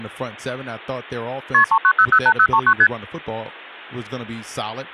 Multi-frequency trunk signalling (R1, as on North American trunks), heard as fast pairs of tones, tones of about 70 ms, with speech in English. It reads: KP 39008039 ST